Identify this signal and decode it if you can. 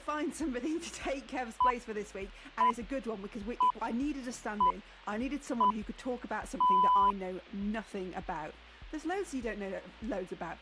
Radio time signal (six pips, as the Greenwich Time Signal), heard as pips, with a squelch burst at the end.